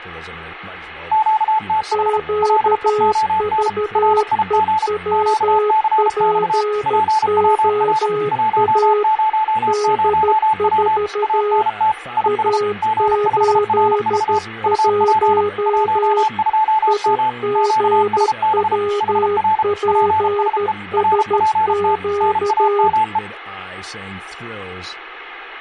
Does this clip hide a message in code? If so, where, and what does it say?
Yes: Morse code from 1.1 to 23.2 s, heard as two keyed tones, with radio static and speech in English. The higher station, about 33 wpm, 870 Hz: QTH LEON RIG QCX PWR 100W ANT IS G5RV UP 12M QSB HR PSE RPT NAME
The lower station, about 13 wpm, 420 Hz: QVEWPOA D4 A81 IGWPSQ